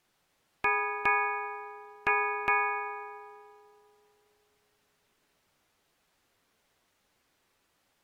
Ship's bell, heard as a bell. 4. Four half-hours of the watch have passed.